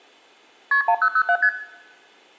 Multi-frequency trunk signalling (R1, as on North American trunks), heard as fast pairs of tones, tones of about 70 ms, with room echo. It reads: KP 1007 ST